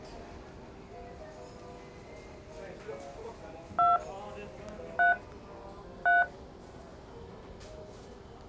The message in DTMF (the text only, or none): 2 3 3